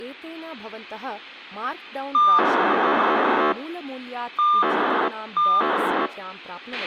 POCSAG pager data (2400 baud), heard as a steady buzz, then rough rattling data, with radio hiss, a squelch burst at the end and speech in Sanskrit.